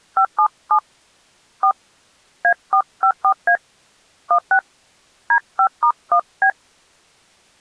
DTMF, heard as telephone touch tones, dialled by hand, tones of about 80 ms. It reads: 577 4 A454A 16 D5*1B